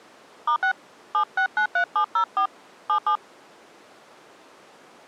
DTMF, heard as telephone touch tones, dialled by hand, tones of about 90 ms. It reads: *6 7693704 77